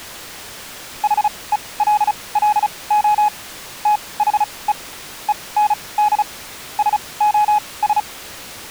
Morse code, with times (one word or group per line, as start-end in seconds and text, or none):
1.0-3.3 HELLO
3.9-4.7 THE
5.3-6.2 END
6.8-8.0 SOS